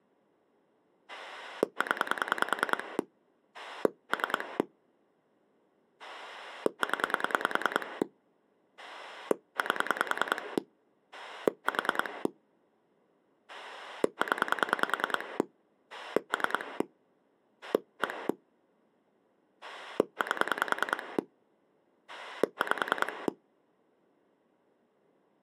Pulse dialling, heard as a rotary dial, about 10 pulses a second. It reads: 0 3 0 8 4 0 3 1 8 5